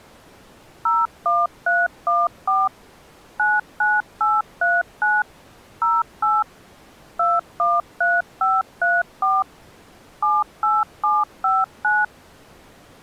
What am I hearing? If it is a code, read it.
DTMF, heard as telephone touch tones, dialled by machine, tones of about 200 ms. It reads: 01314 99839 08 213534 78759